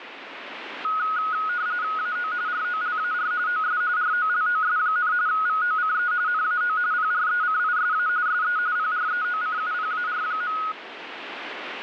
RTTY (45.45 baud, 170 Hz shift), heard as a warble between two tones, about 1360 Hz centre, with radio static. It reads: AO ROLAR OS ROLOS, VOCE NAO PRECISA SE PREOCUPAR.